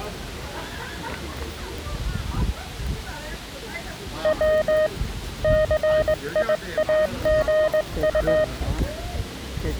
Morse code, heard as a keyed tone, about 19 wpm, 620 Hz, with the noise of a residential street. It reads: W CIAGU